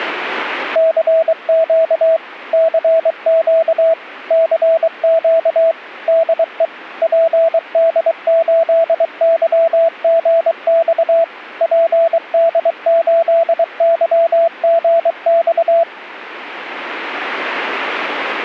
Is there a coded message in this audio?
Yes: Morse code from 0.7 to 15.9 s, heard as a keyed tone, machine-sent, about 23 wpm, 660 Hz. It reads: CQ CQ CQ DE PD8YGX PD8YGX